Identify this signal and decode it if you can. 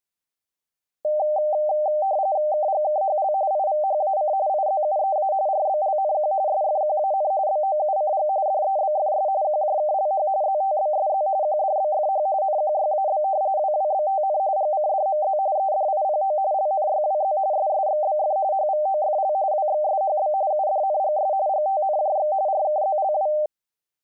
RTTY (45.45 baud, 170 Hz shift), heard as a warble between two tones, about 690 Hz centre. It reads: KGKHL IVHAC IZUEA RBLNQ SFQAN BOUCG DEBFS QJKLH ZTBSZ QDBFH NQYAB WWBTN GCDMZ EDIPO LNYWZ SSXBF HVOFL WXSHB UDNGS GTNJX RKZLW